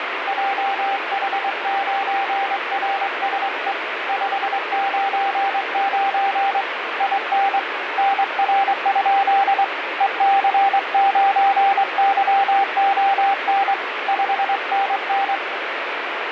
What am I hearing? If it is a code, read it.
Morse code, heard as a keyed tone, hand-sent with a straight key, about 23 wpm, 790 Hz, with heavy radio static. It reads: JH9RSE 599 IN NR? EC9YON 5NN